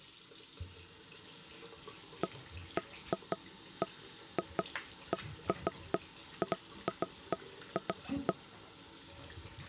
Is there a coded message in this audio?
No, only irregular knocks on wood, with the noise of a restroom.